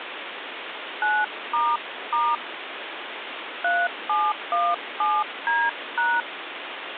DTMF, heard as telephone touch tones, dialled by hand, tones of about 230 ms, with phone line noise. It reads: 9** 3717D#